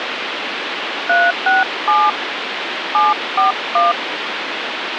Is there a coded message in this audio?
Yes: DTMF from 1.1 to 3.9 s, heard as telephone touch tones, dialled by hand, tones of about 170 ms, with phone line noise. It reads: 367 741